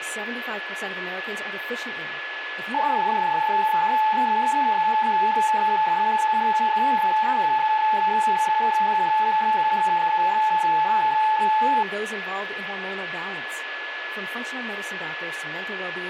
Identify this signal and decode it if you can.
PSK31 (31.25 baud), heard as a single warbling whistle, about 870 Hz, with radio static, a steady whistle near 1710 Hz and speech in English.